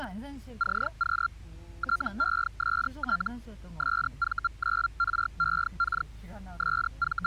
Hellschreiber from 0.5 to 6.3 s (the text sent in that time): CQ TEST SV9REK